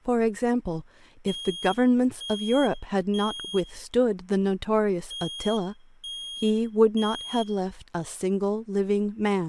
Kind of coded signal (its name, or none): alarm pattern